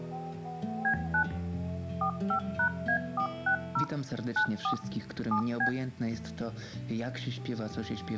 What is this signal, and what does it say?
DTMF, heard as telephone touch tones, dialled by machine, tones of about 90 ms. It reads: B9 45#A460 94 7B